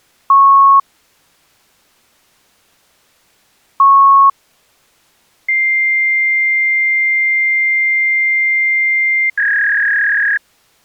Fax machine handshake, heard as beeps, a long tone and a warble.